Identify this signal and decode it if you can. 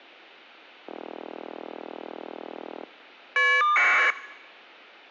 Caller ID data burst, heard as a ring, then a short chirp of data, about 1200 baud.